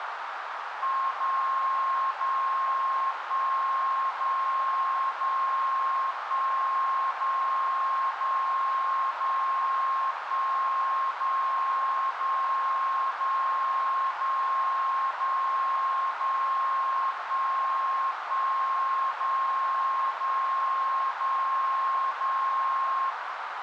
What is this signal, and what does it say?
Radio time signal (DCF77), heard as a tone whose level steps once a second, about 1070 Hz, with radio static and a narrow filter. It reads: 0 0 1 0 0 1 0 0 0 1 0 0 0 0 0 0 1 1 0 0 0 0